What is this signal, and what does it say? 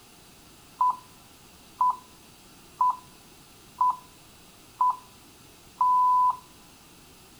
Radio time signal (six pips, as the Greenwich Time Signal), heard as pips, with room echo.